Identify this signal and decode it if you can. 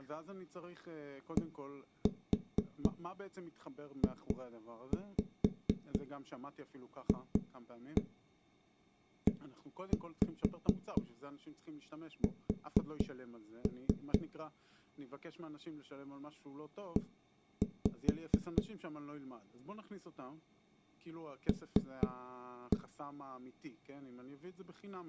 Tap code, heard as knocks on a wall, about 4 knocks a second, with speech in Hebrew. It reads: DJFES E L